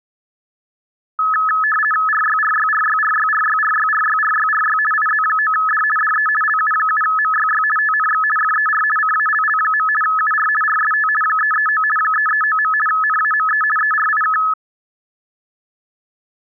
RTTY (50 baud, 450 Hz shift), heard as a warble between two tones, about 1500 Hz centre. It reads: RYRYRYRYRYRYRYRYRY IZ9D DE LU7MYY TNX FER CALL. UR RST 339 339. NAME ERIK